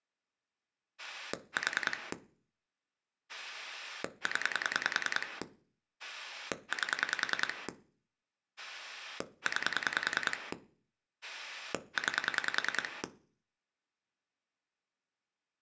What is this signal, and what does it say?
Pulse dialling, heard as a rotary dial, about 10 pulses a second. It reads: 4 0 8 9 9